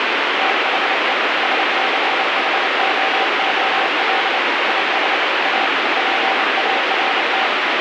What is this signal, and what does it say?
Morse code, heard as a keyed tone, machine-sent, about 28 wpm, 770 Hz, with heavy radio static. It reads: THE SCHOOL IS A PART